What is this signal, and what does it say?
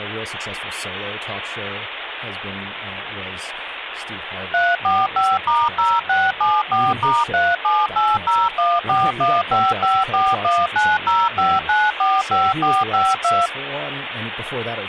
DTMF, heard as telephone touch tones, dialled by machine, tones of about 220 ms, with phone line noise and speech in English. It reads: 345*0674*37801415541905945452